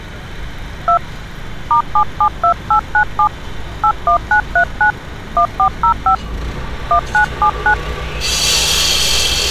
DTMF, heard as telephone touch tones, dialled by hand, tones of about 90 ms, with street noise. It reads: 2 *772897 81939 1405 1979